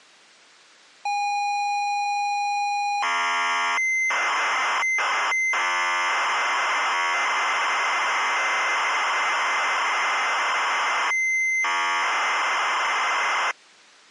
ZX Spectrum tape loading, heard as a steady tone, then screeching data.